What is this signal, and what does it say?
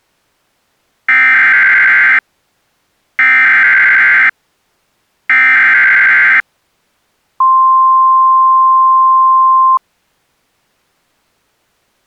Emergency Alert System (SAME) tones (header bursts, then the 1050 Hz attention tone), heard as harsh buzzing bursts, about 520.83 baud.